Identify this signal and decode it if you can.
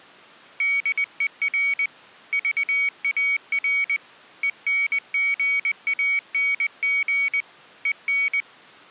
Morse code, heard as a high beeper, hand-sent with a paddle, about 20 wpm, 2250 Hz. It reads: DER VAR ENGANG EN